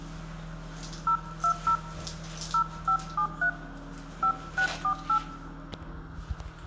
DTMF, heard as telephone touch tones, dialled by hand, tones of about 90 ms, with room echo and the noise of a restroom. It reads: 020 0573 5648